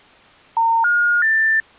Telephone call progress tone (North American plan), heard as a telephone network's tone, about 910, 1430, 1800 Hz. Special information tone.